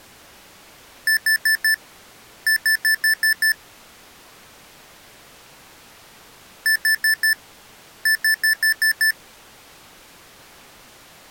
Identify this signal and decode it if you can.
Beep code, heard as beeps from a small speaker, played twice, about 1750 Hz. 4-6.